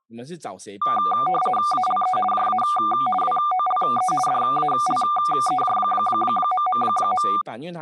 RTTY (50 baud, 450 Hz shift), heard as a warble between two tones, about 970 Hz centre, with speech in Chinese. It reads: ALE JA WOLE DALEJ...